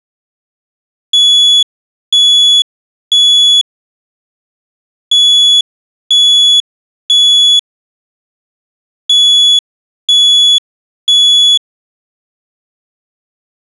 Alarm pattern, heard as an alarm's beeps, played three times, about 3400 Hz. Temporal three. Smoke or fire, evacuate.